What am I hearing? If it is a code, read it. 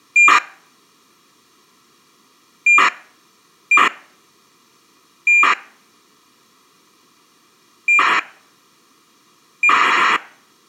ACARS aircraft data, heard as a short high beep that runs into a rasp, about 2400 baud.